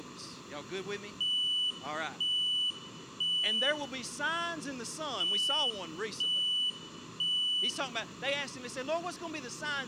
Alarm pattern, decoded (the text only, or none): temporal three